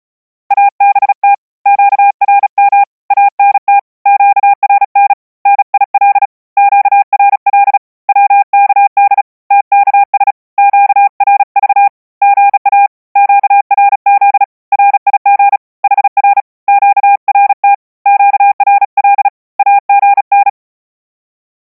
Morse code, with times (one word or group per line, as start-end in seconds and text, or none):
0.5-1.3 ABT
1.7-2.8 QRM
3.1-3.8 ANT
4.1-5.1 QRN
5.5-6.3 NIL
6.6-7.8 QRL
8.1-9.2 WKD
9.5-10.3 TKS
10.6-11.9 QRV
12.2-12.9 GA
13.2-14.4 QRZ
14.7-15.6 RIG
15.8-16.4 HR
16.7-17.7 QRT
18.1-19.3 QRL
19.6-20.5 AGN